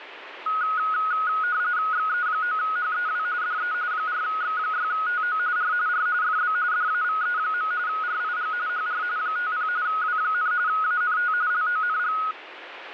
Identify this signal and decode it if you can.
RTTY (45.45 baud, 170 Hz shift), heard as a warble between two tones, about 1360 Hz centre, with radio static. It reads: XE9HEW DE 4X6TO R R FB DAVE. RIG HR 50 W, ANT LONG